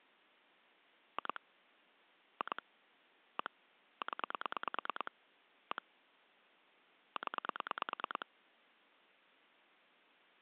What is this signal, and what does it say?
Pulse dialling, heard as clicks on a phone line, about 9 pulses a second. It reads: 2 2 1 0 1 0